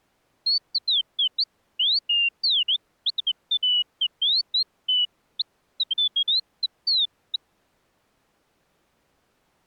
Bird-like chirps. There is no code.